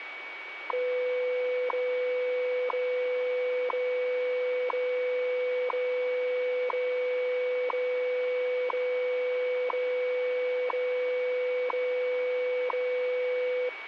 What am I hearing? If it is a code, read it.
Radio time signal (WWV, Colorado), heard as ticks, one a second, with radio static and a steady whistle near 2260 Hz.